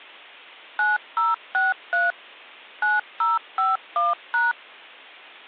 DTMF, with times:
0.8-2.1 9063
2.8-4.5 9051#

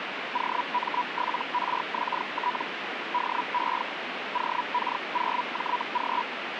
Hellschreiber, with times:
0.3-2.6 OM7RXT
3.1-3.8 DE
4.3-6.2 OK0JG

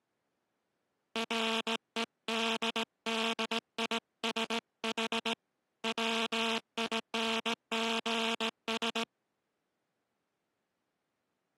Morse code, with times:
1.2-5.3 REDDISH
5.8-9.0 WINGS

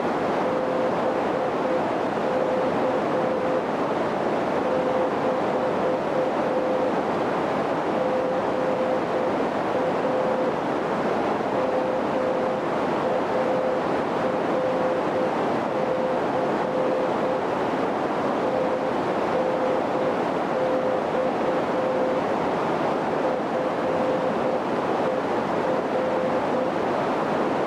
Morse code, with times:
0.4-3.6 BK
4.6-6.9 -
7.9-10.5 GA
11.5-17.4 MARC
18.4-22.2 TNX
23.2-26.7 FER

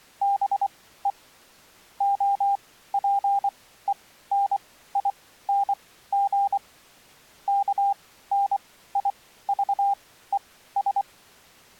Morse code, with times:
0.2-1.1 BE
2.0-6.6 OPENING
7.5-11.0 KNIVES

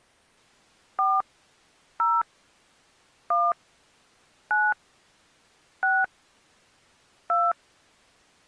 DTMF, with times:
1.0-1.2 4
2.0-2.2 0
3.3-3.5 1
4.5-4.7 9
5.8-6.0 6
7.3-7.5 2

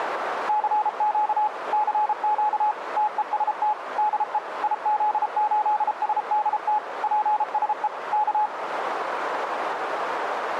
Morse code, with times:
0.5-1.5 CQ
1.7-2.7 CQ
3.0-3.7 TEST
4.0-4.4 DE
4.6-6.8 IZ8SDT
7.0-7.9 PSE
8.1-8.5 K

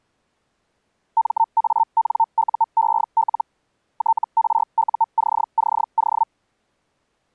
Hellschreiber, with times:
1.2-3.4 MANUEL
4.0-6.2 TRUCCO

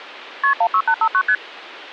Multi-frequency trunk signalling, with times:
0.4-0.5 KP
0.6-1.2 16859
1.3-1.4 ST

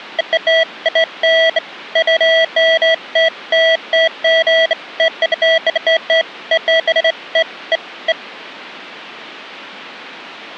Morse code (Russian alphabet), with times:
none

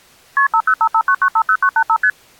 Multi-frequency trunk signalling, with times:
0.4-0.5 KP
0.5-2.0 50559950985
2.0-2.1 ST

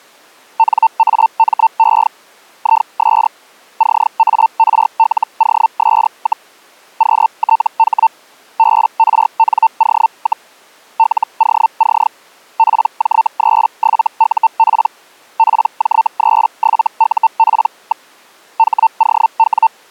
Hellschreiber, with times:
0.6-2.1 NAME
2.6-3.3 IS
3.8-6.5 CARLOS,
7.0-8.1 QTH
8.6-10.5 BRNO,
11.0-12.1 LOC
12.6-14.9 PJ37UP
15.4-18.1 PJ37UP.
18.6-19.7 HOW

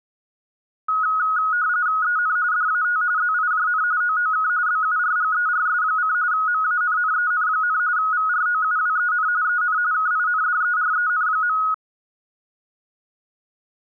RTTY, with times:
2.0-2.4 EN
2.5-3.0 DAT
3.2-3.8 ZIJN
4.0-4.5 OOK
4.7-6.1 BURGERS:
6.3-7.8 MANNEN,
8.0-9.3 VROUWEN
9.4-9.8 EN
9.9-11.6 KINDEREN.

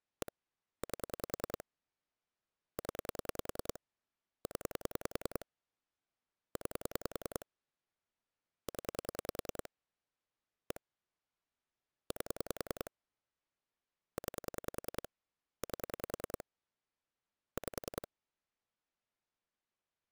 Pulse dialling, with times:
0.2-0.3 1
0.8-1.6 8
2.8-3.8 0
4.5-5.5 0
6.6-7.5 9
8.7-9.7 0
10.7-10.8 1
12.1-12.9 8
14.2-15.1 9
15.6-16.4 8
17.6-18.1 5

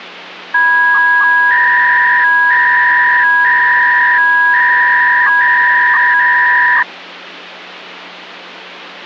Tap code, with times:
none

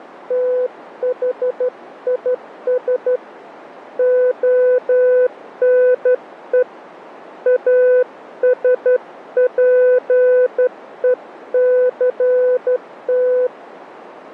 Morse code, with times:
0.3-3.2 THIS
4.0-6.6 ONE
7.5-13.5 ASPECT

